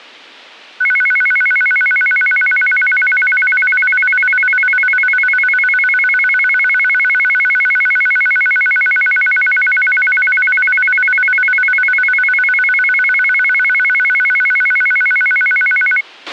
A tone that alternates evenly between two pitches, with a squelch burst at the end. There is no code.